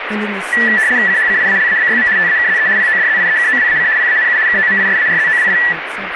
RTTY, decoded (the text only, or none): CHCIALABYM TAKZE PODZIEKOWAC PANU KOMISARZOWI